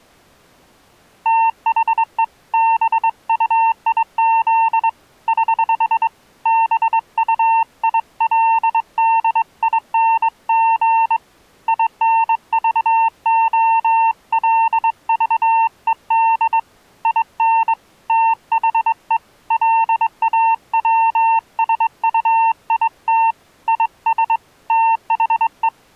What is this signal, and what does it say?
Morse code, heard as a keyed tone, hand-sent with a straight key, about 22 wpm, 900 Hz. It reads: THE BUIZ <HH> BUILDING INVOLVED IN THE LAWSUIT IS THE